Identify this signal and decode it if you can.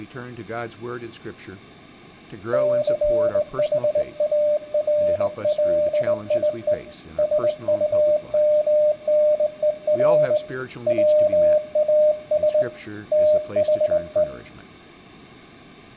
Morse code, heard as a keyed tone, hand-sent with a straight key, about 19 wpm, 600 Hz, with room echo and speech in English. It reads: CHARLIE SUMNER WAS THE